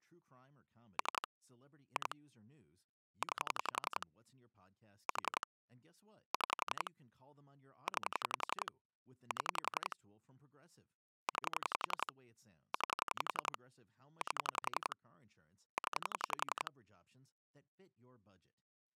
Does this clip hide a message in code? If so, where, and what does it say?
Yes: pulse dialling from 1.0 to 16.7 s, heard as clicks on a phone line, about 11 pulses a second, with speech in English. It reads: 3 2 9 4 6 9 7 9 9 8 0